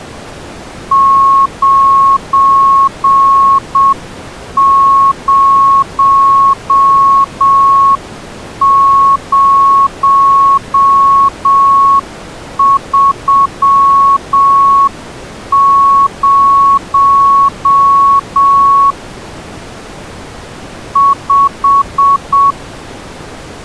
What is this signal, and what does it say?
Morse code, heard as a keyed tone, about 7 wpm, 1100 Hz. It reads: 90030 5